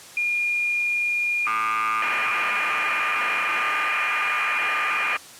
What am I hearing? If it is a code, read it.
Cassette data (Kansas City type), 1200 baud, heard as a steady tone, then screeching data.